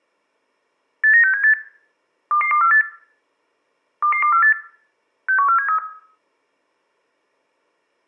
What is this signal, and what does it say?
Five-tone selective call (CCIR), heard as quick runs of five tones, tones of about 100 ms, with room echo. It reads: 89678 22248 22248 61473